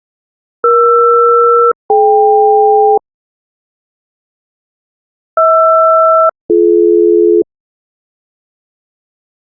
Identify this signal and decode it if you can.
Aircraft SELCAL, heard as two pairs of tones. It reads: ER-DK HR-BD